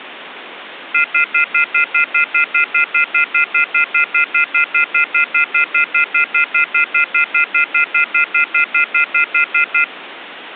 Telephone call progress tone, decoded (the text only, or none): off-hook warning tone